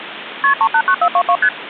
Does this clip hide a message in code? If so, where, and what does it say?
Yes: multi-frequency trunk signalling (R1, as on North American trunks) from 0.4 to 1.5 s, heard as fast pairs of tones, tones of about 70 ms, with phone line noise. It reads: KP 389422 ST